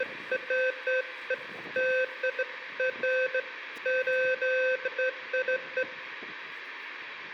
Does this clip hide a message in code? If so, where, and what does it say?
No, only beeps of irregular length, with room echo and the noise of a residential street.